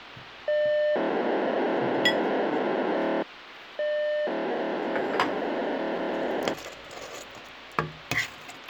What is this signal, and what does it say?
POCSAG pager data (1200 baud), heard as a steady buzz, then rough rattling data, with radio hiss, a squelch burst at the end and kitchen noise.